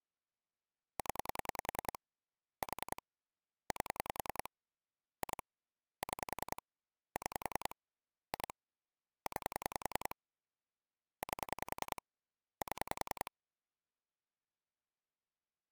Pulse dialling, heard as clicks on a phone line, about 10 pulses a second. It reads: 0 4 8 2 6 6 2 9 8 7